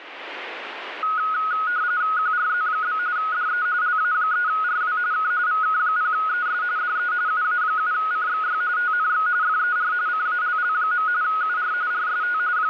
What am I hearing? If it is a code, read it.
RTTY (45.45 baud, 170 Hz shift), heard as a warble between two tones, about 1360 Hz centre, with radio static. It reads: QRZ? DE LA3RW K VK0ES DE UA7CXY TNX FER CALL. UR RST …